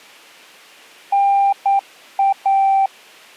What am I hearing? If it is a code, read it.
Morse code (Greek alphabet), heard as a keyed tone, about 9 wpm, 790 Hz. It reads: ΝΑ